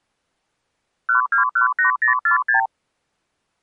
Multi-frequency trunk signalling (R2, with the far end's replies), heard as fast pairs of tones, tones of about 120 ms. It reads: 1218046